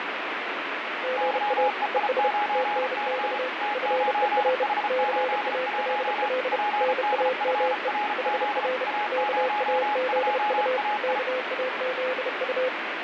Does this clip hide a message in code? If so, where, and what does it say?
Yes: Morse code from 1.0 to 12.7 s, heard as two keyed tones, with heavy radio static. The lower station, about 31 wpm, 510 Hz: GA ES TNX FER CALL NAME HR KAZU KAZU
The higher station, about 34 wpm, 830 Hz: YEI9C T9H81 PDFRZ A02AI